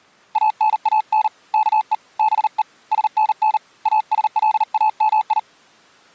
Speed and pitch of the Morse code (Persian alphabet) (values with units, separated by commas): 39 wpm, 860 Hz